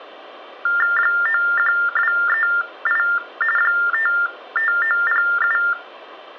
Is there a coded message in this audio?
Yes: TTY/TDD text telephone tones (45.45 baud Baudot) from 0.7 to 5.7 s, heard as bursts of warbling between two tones, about 400 Hz shift, 1600 Hz centre, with room echo. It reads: 91238 55907